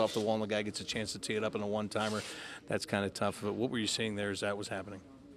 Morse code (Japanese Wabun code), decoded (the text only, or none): none